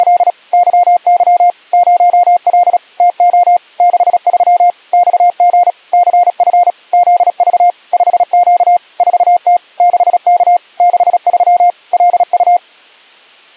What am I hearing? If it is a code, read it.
Morse code, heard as a keyed tone, machine-sent, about 36 wpm, 710 Hz. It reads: … YY 0L TO 63 XG CF ZV 5Q 4T 6K 63 LU